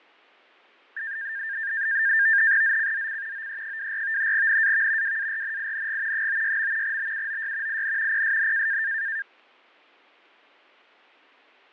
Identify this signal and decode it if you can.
NAVTEX (SITOR-B), 100 baud, 170 Hz shift, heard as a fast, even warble, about 1700 Hz centre, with fading. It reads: ZCZC OE24 NAV WARNING 96. BUOY IN PSN